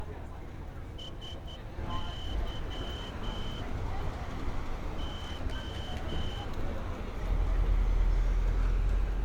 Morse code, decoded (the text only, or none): SY O